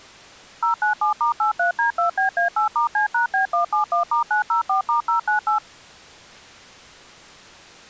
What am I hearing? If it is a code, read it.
DTMF, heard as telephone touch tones, dialled by machine, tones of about 120 ms. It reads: 097*83D2BA8*C#B171*904*098